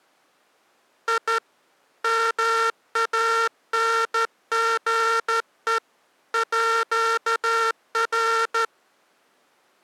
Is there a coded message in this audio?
Yes: Morse code (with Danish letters) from 1.0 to 8.7 s, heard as a buzzer, hand-sent with a straight key, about 13 wpm. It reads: I MANGE ÅR